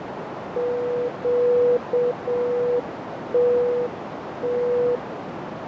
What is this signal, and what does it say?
Morse code, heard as a keyed tone, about 7 wpm, 490 Hz, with heavy radio static, fading and a narrow filter. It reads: QTT